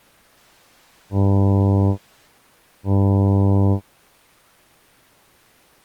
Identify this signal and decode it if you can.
Ship horn signal, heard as a ship's horn, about 100 Hz. 2 short. At sea: I am altering course to port.